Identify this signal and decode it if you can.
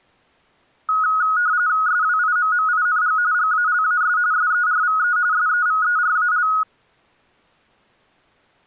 RTTY (45.45 baud, 170 Hz shift), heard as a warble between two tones, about 1360 Hz centre. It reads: SWIMMING GALAS SERVE SEVERAL